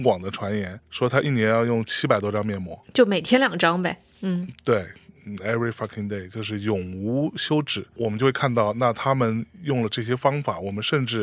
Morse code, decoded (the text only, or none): none